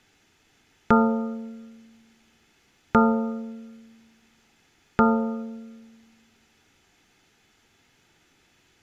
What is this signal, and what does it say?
Clock strike, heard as a bell. 3. Three o'clock.